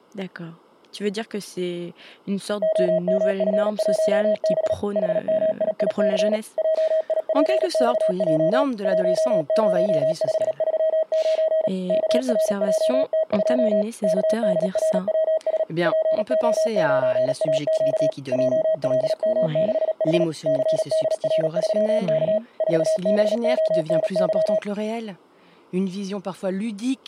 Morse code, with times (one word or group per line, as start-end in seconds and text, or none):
2.6-4.7 OMF1B
5.0-6.4 HMIIC
6.6-8.6 JIPXJ
8.9-11.7 10539
11.9-13.8 KRJT2
14.0-15.6 KDRWS
15.9-18.1 PO9AQ
18.3-20.2 JLM6H
20.5-22.4 CDR3K
22.6-24.6 4BONY